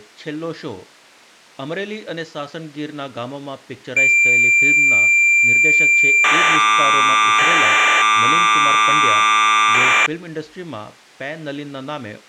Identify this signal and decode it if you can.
Cassette data (Kansas City type), 1200 baud, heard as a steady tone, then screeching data.